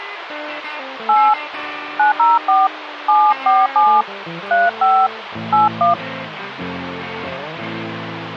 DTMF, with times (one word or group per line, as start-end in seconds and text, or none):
1.1-1.3 8
2.0-2.7 904
3.1-4.0 747
4.5-5.1 35
5.5-5.9 81